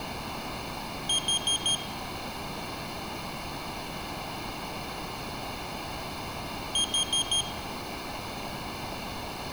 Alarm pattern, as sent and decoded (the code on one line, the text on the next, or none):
4 beeps and a pause
temporal four